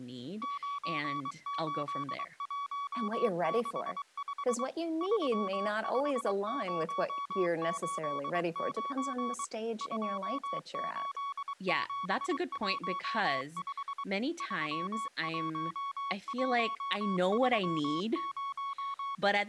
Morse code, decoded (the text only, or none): 98165 35089 28715 31130